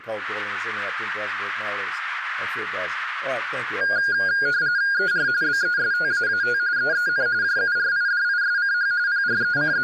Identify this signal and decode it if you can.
RTTY (45.45 baud, 170 Hz shift), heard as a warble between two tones, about 1550 Hz centre, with radio static and speech in English. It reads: ER BESTAAT EEN JURIDISCH …